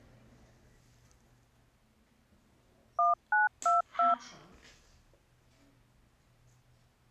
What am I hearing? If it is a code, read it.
DTMF, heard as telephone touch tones, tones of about 150 ms, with the noise inside a lift. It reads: 1922